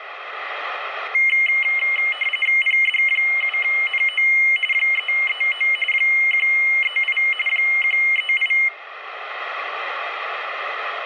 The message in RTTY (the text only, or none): PD7NO 339 138 138